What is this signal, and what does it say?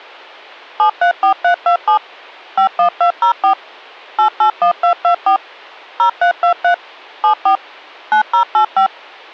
DTMF, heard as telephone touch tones, dialled by machine, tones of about 100 ms. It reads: 734327 51204 881224 0323 74 9085